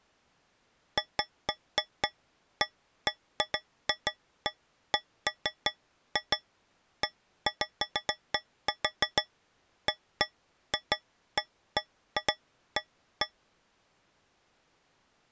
Irregular taps on a metal pipe. There is no code.